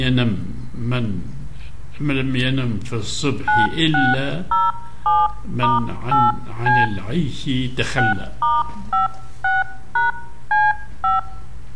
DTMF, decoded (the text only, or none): 9607*8C 6*56#C5